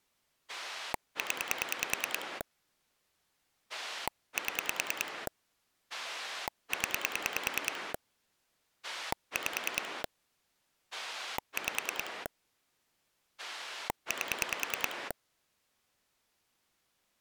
Pulse dialling, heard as a rotary dial, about 10 pulses a second. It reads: 0 7 0 5 5 8